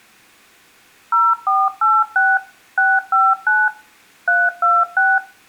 DTMF, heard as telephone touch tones, dialled by machine, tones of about 220 ms, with room echo. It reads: 0486 659 326